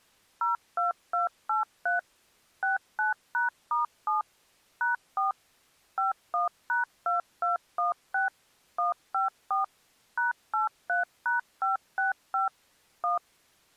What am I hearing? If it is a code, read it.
DTMF, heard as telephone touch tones, dialled by machine, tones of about 140 ms. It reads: 02283 69#*7 #4 51#2216 154 #83#565 1